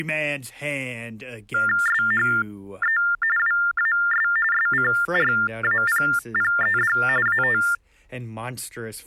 TTY/TDD text telephone tones (45.45 baud Baudot), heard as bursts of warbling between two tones, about 400 Hz shift, 1600 Hz centre, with speech in English. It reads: SHE WAS SCRAPPED AT